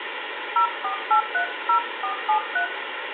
DTMF, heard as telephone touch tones, dialled by hand, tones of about 100 ms, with phone line noise and room echo. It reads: 04830473